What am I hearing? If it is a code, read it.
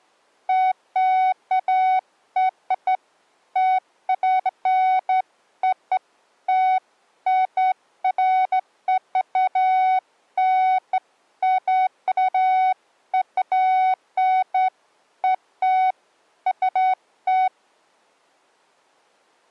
Beeps of irregular length. There is no code.